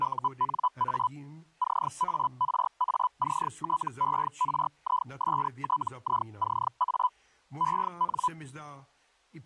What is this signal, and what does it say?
Hellschreiber (Feld-Hell, 122.5 baud), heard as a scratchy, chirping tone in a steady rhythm, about 1000 Hz, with speech in Czech. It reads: UNA CARACTERISTICA EN